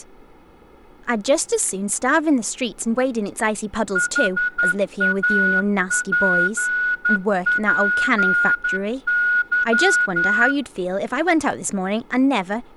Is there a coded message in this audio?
Yes: Morse code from 3.9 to 10.6 s, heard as a whistle, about 11 wpm, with room echo and speech in English. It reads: HAPPY